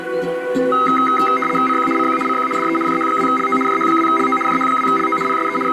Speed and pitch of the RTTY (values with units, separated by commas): 75 baud, 850 Hz shift, 1700 Hz centre